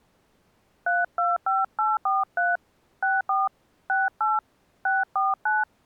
DTMF, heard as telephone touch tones, dialled by hand, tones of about 180 ms. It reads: 325843 64 68 649